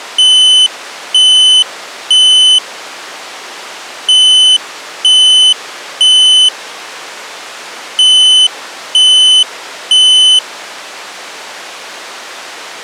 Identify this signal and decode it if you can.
Alarm pattern, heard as an alarm's beeps, played three times, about 3000 Hz. Temporal three. Smoke or fire, evacuate.